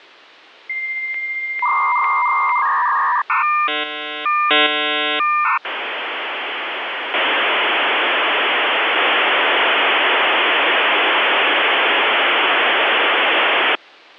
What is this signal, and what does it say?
Dial-up modem handshake (V.34 or later), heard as a whistle, warbles, then hiss.